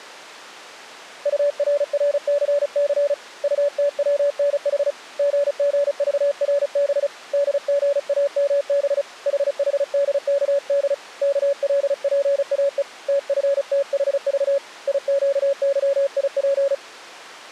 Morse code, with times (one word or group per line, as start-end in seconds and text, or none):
1.3-3.1 URRCC
3.4-4.9 UTWNH
5.2-7.1 GGVRB
7.3-9.0 DGAMB
9.3-10.9 HHDKD
11.2-12.8 KLPAE
13.1-14.6 TFTHV
14.9-16.7 IQYIP